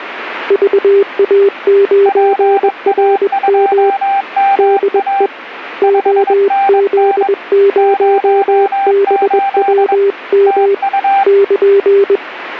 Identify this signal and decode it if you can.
Morse code, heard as two keyed tones. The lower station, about 21 wpm, 400 Hz: VA9RM DE OZ0BWM <KN>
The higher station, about 22 wpm, 790 Hz: PA2MA 5NN 08 TU